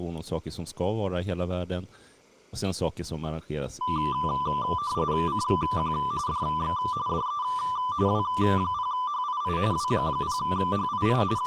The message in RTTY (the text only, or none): CQ DX DE W0HII W0HII …